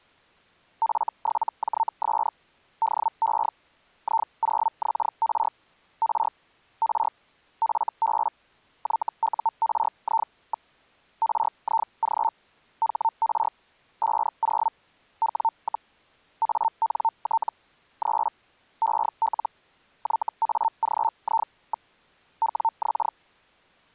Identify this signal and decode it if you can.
Hellschreiber (Feld-Hell, 122.5 baud), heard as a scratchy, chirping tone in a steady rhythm, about 900 Hz. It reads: F7JS DE I0XR R R FB YURI. RIG HR 50 W, ANT 3 EL YAGI. WX